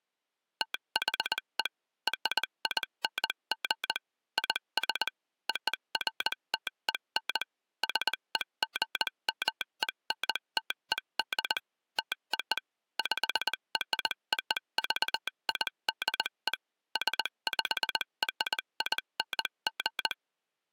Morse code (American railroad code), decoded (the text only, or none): THE RING IS OFTEN SEGMENTED TO PROVIDE SPRING